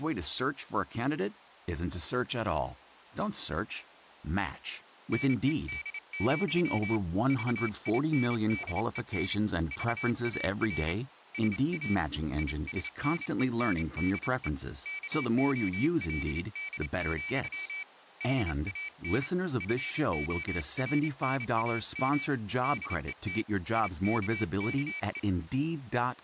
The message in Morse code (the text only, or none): NED, VINDEN VAR SA ISNENDE KOLD, HAN FORNAM DET IKKE